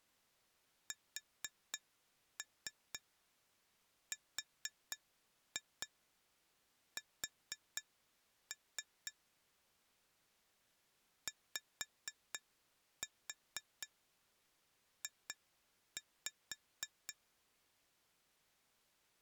Tap code, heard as taps on glass, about 4 knocks a second. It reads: SRS YJ